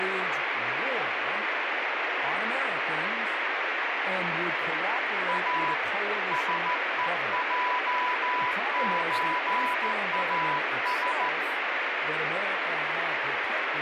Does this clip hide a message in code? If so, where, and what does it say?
Yes: Morse code (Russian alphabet) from 5.2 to 11.3 s, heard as a keyed tone, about 14 wpm, 990 Hz, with heavy radio static and speech in English. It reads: А СЕЙЧАС